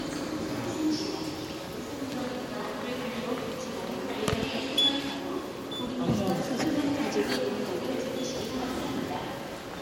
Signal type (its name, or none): none